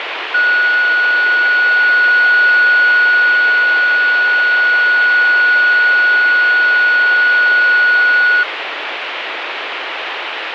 A steady tone, with radio static. There is no code.